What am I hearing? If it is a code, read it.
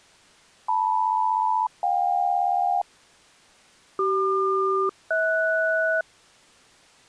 Aircraft SELCAL, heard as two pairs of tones. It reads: LM-JK CQ-HS